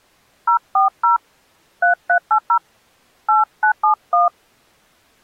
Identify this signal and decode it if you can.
DTMF, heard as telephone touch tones, dialled by hand, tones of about 110 ms. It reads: 040 3380 8971